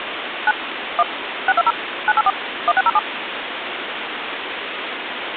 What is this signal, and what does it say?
DTMF, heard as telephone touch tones, dialled by machine, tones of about 40 ms, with phone line noise. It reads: 9 1 620 984 1607